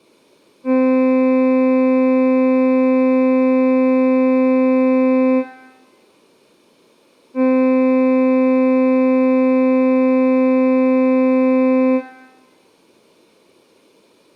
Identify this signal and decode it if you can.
Ship horn signal, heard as a ship's horn, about 260 Hz, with room echo. 2 long. At sea: a vessel under power that has stopped in fog.